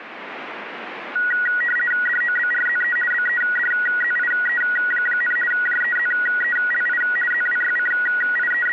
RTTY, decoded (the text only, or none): DOBRZE BEDZIE, JEZELI …